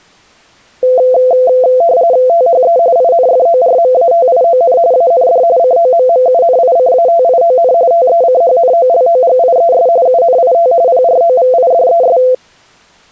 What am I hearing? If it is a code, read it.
RTTY (45.45 baud, 170 Hz shift), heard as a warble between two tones, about 590 Hz centre. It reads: THE INFORMATION AND COMMUNICATION TECHNOLOGIES UNIT PROVIDES